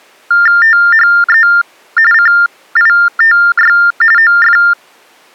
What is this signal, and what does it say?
TTY/TDD text telephone tones (45.45 baud Baudot), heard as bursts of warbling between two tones, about 400 Hz shift, 1600 Hz centre. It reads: THE CITY OF